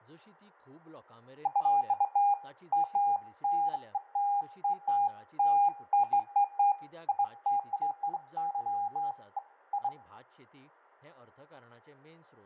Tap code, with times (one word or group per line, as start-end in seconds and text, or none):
none